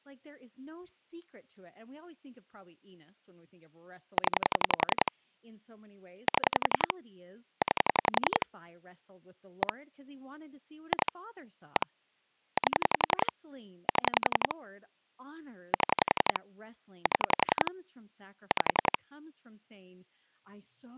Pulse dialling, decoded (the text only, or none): 0 7 9 1 2 1 8 7 7 7 5